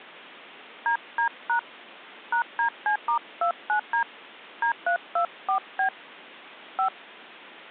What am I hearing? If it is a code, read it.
DTMF, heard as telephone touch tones, dialled by hand, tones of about 100 ms. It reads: DD# #DC*29D D324B 5